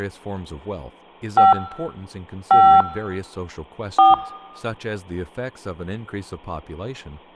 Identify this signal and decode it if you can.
DTMF, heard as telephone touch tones, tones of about 220 ms, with speech in English. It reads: 5 5 4